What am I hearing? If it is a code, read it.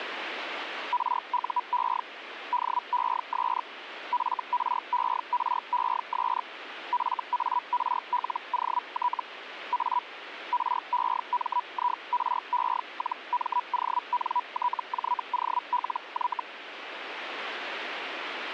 Hellschreiber (Feld-Hell, 122.5 baud), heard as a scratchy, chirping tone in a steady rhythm, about 980 Hz, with radio static. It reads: RUE DES FRERES FARLOT A REMIRE-MONTJOLY